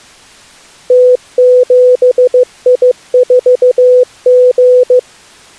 Morse code, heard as a keyed tone, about 15 wpm, 500 Hz. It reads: T7I4G